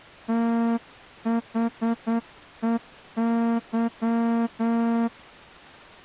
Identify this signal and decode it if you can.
Morse code, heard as a horn, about 9 wpm. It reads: THEY